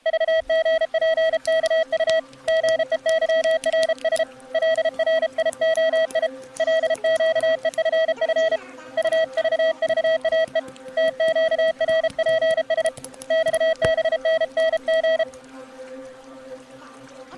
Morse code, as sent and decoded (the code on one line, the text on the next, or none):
...- --. .--. -.- ..- / --. . -.-- .-. ... / .-.. .-. .. --- .. / .-.. --.- . ..-. ..-. / ..- ...- ...- .- . / - --.- .-. .--. ... / -..- -... -. -. --.
VGPKU GEYRS LRIOI LQEFF UVVAE TQRPS XBNNG